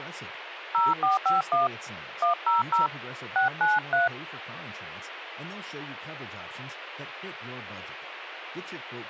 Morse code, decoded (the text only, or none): none